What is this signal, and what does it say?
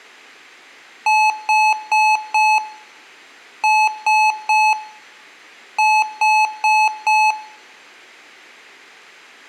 Beep code, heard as beeps from a small speaker, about 860 Hz, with room echo. 4-3-4. In Phoenix BIOS tables: time-of-day clock failure.